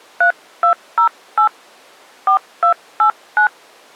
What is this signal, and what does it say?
DTMF, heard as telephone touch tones, dialled by hand, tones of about 100 ms. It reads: 3208 4289